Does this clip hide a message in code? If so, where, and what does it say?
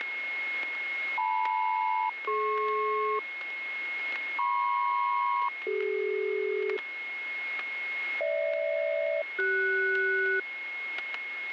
Yes: aircraft SELCAL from 1.2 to 10.4 s, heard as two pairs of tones, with static crashes and a steady whistle near 2160 Hz. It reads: LM-DP MP-CD GH-CS